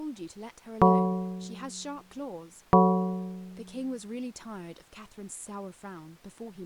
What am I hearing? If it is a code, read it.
Clock strike, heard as a bell, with speech in English. 2. Two o'clock.